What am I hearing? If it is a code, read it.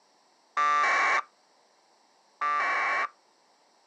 Packet radio (AX.25, as in APRS), 1200 baud, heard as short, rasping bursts.